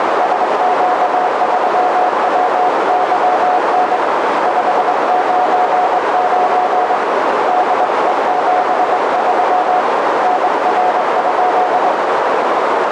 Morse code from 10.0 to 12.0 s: NR?

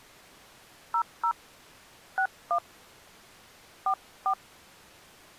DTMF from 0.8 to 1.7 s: 00

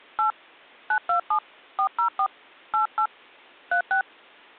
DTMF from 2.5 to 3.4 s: 88

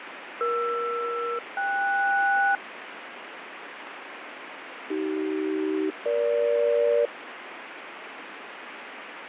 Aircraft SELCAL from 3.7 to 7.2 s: AC-EG

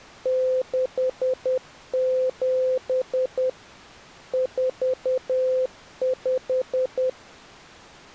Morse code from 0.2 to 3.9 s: 67

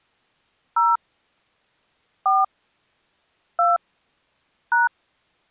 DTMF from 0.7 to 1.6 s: 0

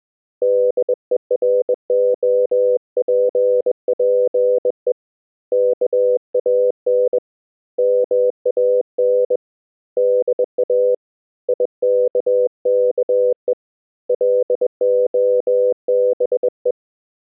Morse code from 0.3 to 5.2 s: DEROPPE

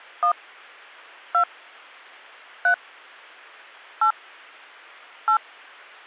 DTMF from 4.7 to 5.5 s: 8

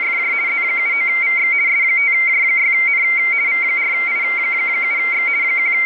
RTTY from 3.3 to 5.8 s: V4I7X …

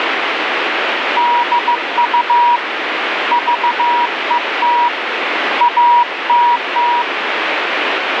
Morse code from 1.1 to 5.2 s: DU VET

